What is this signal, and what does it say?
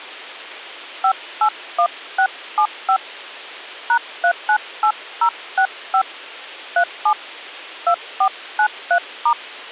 DTMF, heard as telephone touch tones, dialled by hand, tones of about 80 ms. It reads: 581675 #398065 37 2493*